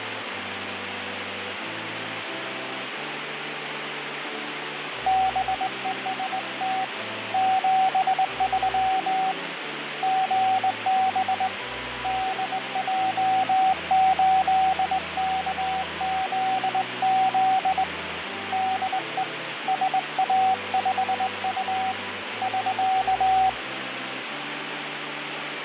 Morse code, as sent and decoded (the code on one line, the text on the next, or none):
-... . ... - / --... ...-- / --. -... / -.. .--- ---.. -.- --.. --.. / -.. . / ... .- ..... ..- / ...-.-
BEST 73 GB DJ8KZZ DE SA5U <SK>